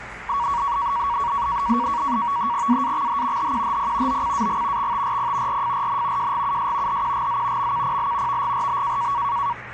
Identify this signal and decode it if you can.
NAVTEX (SITOR-B), 100 baud, 170 Hz shift, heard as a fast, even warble, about 1040 Hz centre, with radio static and the noise inside a lift. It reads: AAXH HQHP OCAG XTRP RFRN JGUS HQGZ MKPL VGRB